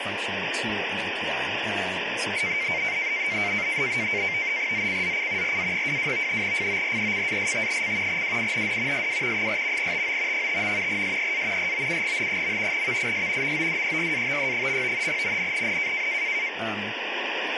NAVTEX (SITOR-B), 100 baud, 170 Hz shift, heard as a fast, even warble, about 2200 Hz centre, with radio static and speech in English. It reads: ZCZC RA22 FORECAST: WIND SW 4 TO 5. SEA ROUGH. VIS MODERATE. NNNN